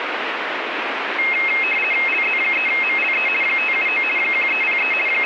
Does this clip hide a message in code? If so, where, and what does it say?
Yes: RTTY (50 baud, 450 Hz shift) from 1.2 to 5.3 s, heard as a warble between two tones, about 2350 Hz centre, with radio static. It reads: LZ3MLE 579 1303 …